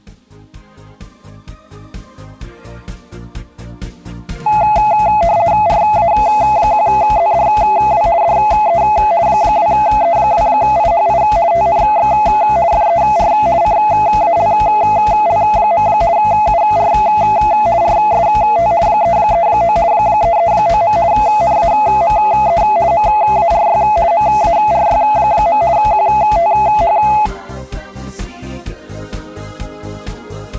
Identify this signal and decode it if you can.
RTTY (50 baud, 170 Hz shift), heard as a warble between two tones, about 760 Hz centre. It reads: RA1ZDW DE 2E2IHI TNX FER CALL. UR RST 339 339. NAME MARY MARY. QTH